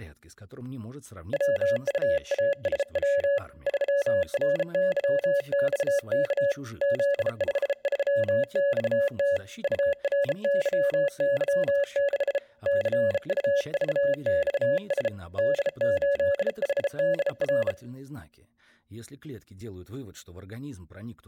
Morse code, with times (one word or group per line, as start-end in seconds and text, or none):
1.3-3.4 WUASW
3.7-6.5 3RYXK
6.8-9.4 Z53XT
9.6-12.4 URYY6
12.7-15.1 CUVXS
15.4-17.7 D8HDR